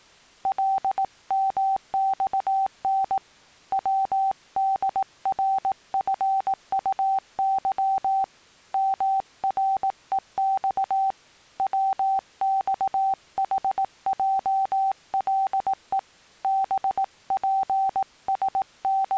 Morse code, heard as a keyed tone, hand-sent with a paddle, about 18 wpm, 780 Hz. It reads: LMXN WDRFUY MREX WXHJLE …